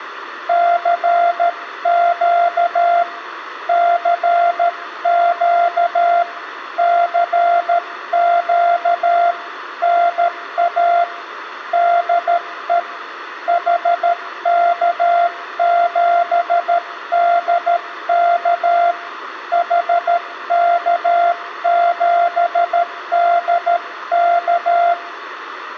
Morse code, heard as a keyed tone, hand-sent with a paddle, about 13 wpm, 690 Hz, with room echo. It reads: CQ CQ CQ NA DE HK7DK HK7DK